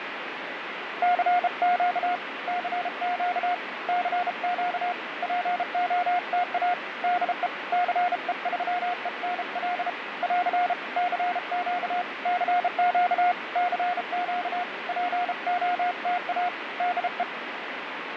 Morse code, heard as a keyed tone, hand-sent with a bug key, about 33 wpm, 710 Hz, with radio static. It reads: CQ CQ CQ POTA DE CE3ENL <AR> CQ CQ CQ POTA DE